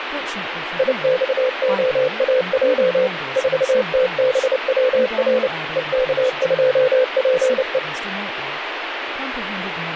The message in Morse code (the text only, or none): IXOAJ 4TBWR EK2PE